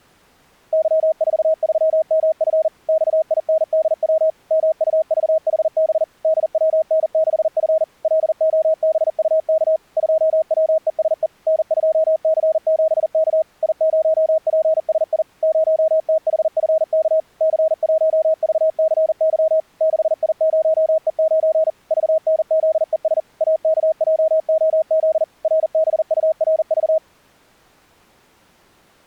Morse code, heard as a keyed tone, machine-sent, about 40 wpm, 640 Hz. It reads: Y43MF XINDW MUVHB DWN6F LOBUK 2WESE N2C7K I0PSI 0THFK C1VCY 6I0E9 VNZES AKJOZ RBURV